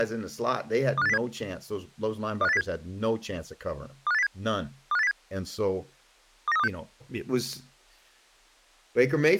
Five-tone selective call (EEA), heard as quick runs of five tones, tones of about 40 ms, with speech in English. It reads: 25807 25807 25807 25807 29326